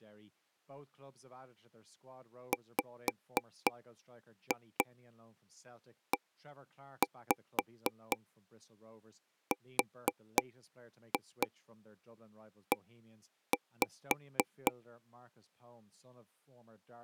Tap code, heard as taps on a table, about 4 knocks a second, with speech in English. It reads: WERE